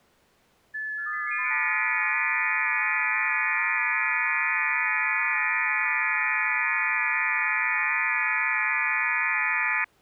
FT8 (several signals at once), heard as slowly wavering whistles, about 6.25 baud.